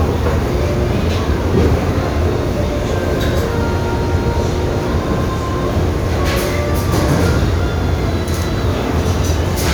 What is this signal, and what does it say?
The noise of a restaurant. There is no code.